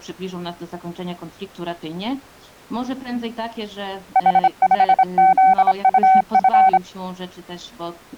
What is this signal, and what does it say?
Morse code, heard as a keyed tone, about 26 wpm, 760 Hz. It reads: H5ZUF